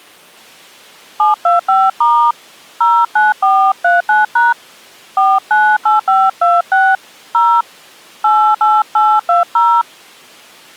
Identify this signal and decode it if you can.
DTMF, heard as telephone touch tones, dialled by hand, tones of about 230 ms. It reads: 725* 09439# 498526 0 88820